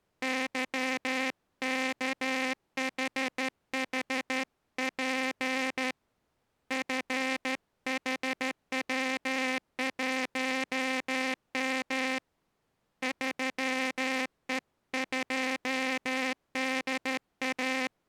Morse code, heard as a buzzer, hand-sent with a straight key, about 13 wpm. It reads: YKHHP FHW1M 3E2DA